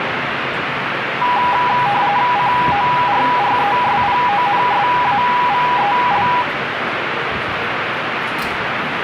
RTTY (45.45 baud, 170 Hz shift), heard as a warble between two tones, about 900 Hz centre, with radio static and the noise of a subway station. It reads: CORRESPONSAVEL